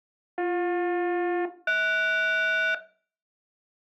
Aircraft SELCAL, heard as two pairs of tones. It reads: BJ-HS